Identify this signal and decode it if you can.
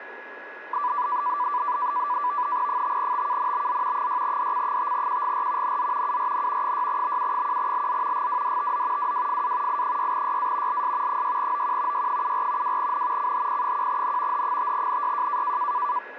NAVTEX (SITOR-B), 100 baud, 170 Hz shift, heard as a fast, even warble, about 1080 Hz centre, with radio static and a steady whistle near 1680 Hz. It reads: 5TKNBZ 6DC5QGR NZ URN 6BU1LZ GWDTZ WWFA I6YA LS 6OQ Y74 2N CHP1N H5NYJ